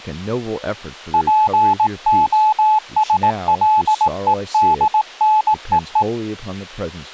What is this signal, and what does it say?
Morse code (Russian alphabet), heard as a keyed tone, hand-sent with a paddle, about 18 wpm, 860 Hz, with speech in English. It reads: ПОСЛЕДНЕЕ